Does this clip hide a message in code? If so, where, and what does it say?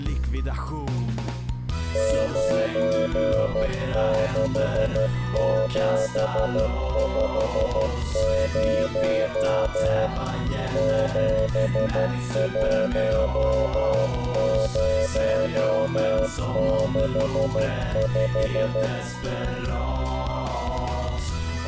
Yes: Morse code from 1.9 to 18.9 s, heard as a keyed tone, machine-sent, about 12 wpm, 550 Hz. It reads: 96750 71065